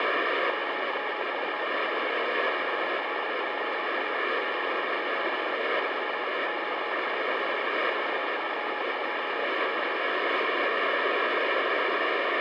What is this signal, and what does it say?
Morse code, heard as a keyed tone, hand-sent with a paddle, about 36 wpm, 840 Hz, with radio static. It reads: KWV DE PLJA QTC 3 QSW 432 K